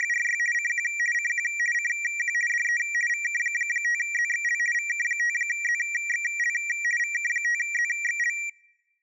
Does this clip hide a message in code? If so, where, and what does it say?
Yes: RTTY (50 baud, 450 Hz shift) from 0.0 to 8.5 s, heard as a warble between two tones, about 2150 Hz centre. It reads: … CQ CQ CQ DE VK5ZXL VK5ZXL VK5ZXL